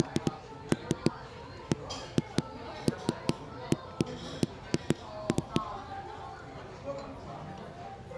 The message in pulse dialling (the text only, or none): none